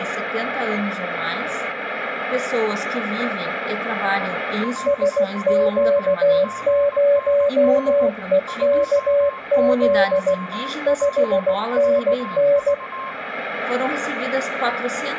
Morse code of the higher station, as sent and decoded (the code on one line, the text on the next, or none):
.-.. ...-- .--. -. .-. / ..--- ----- .--. ....- ...-
L3PNR 20P4V